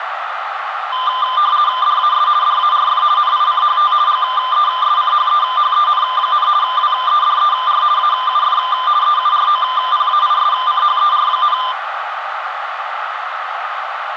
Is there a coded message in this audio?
Yes: RTTY (50 baud, 170 Hz shift) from 0.9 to 11.7 s, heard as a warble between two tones, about 1110 Hz centre, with radio static and a narrow filter. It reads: DAS DARF NICHT GESCHEHEN, WEDER AUF EUROPAISCHER,